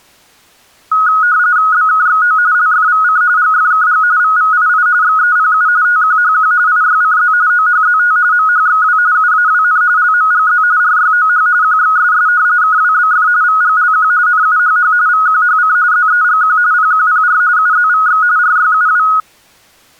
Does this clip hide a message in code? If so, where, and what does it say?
Yes: RTTY (45.45 baud, 170 Hz shift) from 0.9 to 19.2 s, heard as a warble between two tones, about 1360 Hz centre. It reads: BKXO LFVC GFKG VVII XEPU TQHQ IYCZ OHZT MHXW UAWN LMGZ RYOH QXSS KWBF VGLQ NUHH VQHC ZEGQ PQPR UZVX RYUW